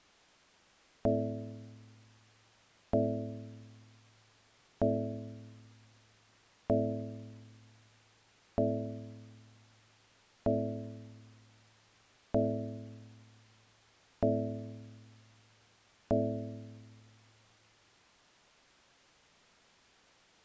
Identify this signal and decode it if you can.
Clock strike, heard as a bell. 9. Nine o'clock.